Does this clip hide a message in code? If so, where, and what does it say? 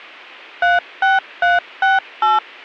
Yes: DTMF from 0.6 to 2.4 s, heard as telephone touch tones, dialled by machine, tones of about 170 ms. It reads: 36368